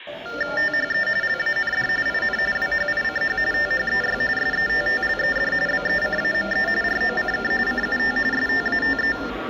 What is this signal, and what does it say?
TTY/TDD text telephone tones (45.45 baud Baudot), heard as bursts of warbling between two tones, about 400 Hz shift, 1600 Hz centre, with phone line noise and the noise of a subway station. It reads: THE LAND IN WHICH THEY SETTLED BECAME ROCK CUT STATE